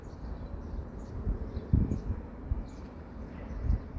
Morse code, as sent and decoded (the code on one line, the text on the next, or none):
none